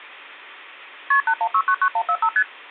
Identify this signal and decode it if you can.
Multi-frequency trunk signalling (R1, as on North American trunks), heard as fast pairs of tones, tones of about 70 ms. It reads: KP 81699145 ST